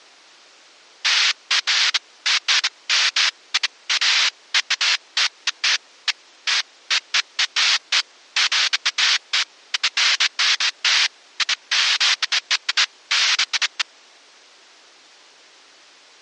Bursts of noise. There is no code.